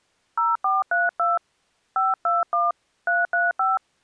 DTMF, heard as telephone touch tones, dialled by hand, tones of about 180 ms. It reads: 0432 521 335